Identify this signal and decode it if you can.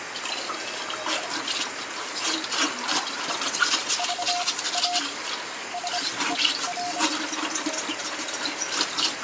Morse code, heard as a keyed tone, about 25 wpm, spaced as for 17 wpm, 710 Hz, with radio static and kitchen noise. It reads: VA SER